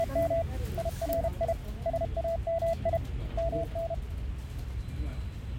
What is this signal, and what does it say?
Morse code (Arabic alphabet), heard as a keyed tone, hand-sent with a paddle, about 32 wpm, 670 Hz, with the noise of a crowd indoors. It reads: … يري سامي من